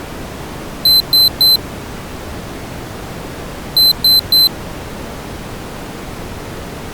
Beep code, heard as a piezo beeper, played twice, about 4050 Hz. 3 short. In AMI BIOS tables: failure in the first 64 KB of memory; in Dell tables: chipset error.